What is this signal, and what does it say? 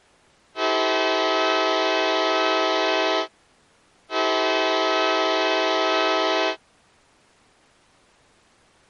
Train horn signal, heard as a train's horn. 2 long. On North American railways: brakes released, proceed.